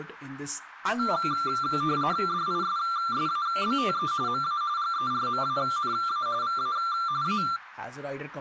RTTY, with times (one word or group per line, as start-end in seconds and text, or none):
2.3-4.1 DISSABTE
4.3-4.6 MA
4.8-6.3 GERMANA
6.4-6.8 VA
7.2-7.4 A